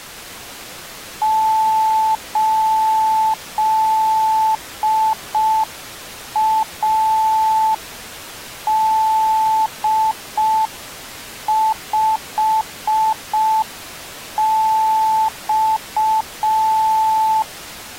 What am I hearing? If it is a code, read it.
Morse code, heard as a keyed tone, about 5 wpm, 880 Hz. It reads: 8AD5X